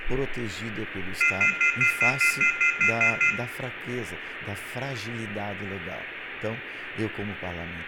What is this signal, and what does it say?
Telephone call progress tone (North American plan), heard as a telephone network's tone, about 1400, 2050, 2450, 2600 Hz, 0.1 s on and 0.1 s off, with phone line noise and room echo. Off-hook warning tone.